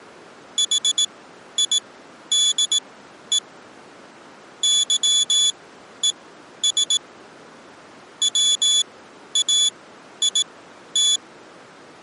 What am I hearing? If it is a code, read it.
Morse code, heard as a high beeper, machine-sent, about 18 wpm, spaced as for 11 wpm, 3450 Hz. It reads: HIDE YES WAIT